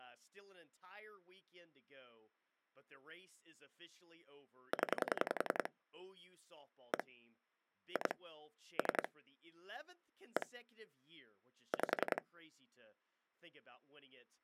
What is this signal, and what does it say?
Pulse dialling, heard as clicks on a phone line, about 10 pulses a second, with speech in English. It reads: 0 1 2 3 1 5